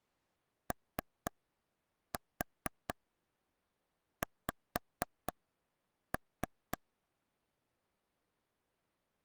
Tap code, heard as taps on a table, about 4 knocks a second. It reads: OX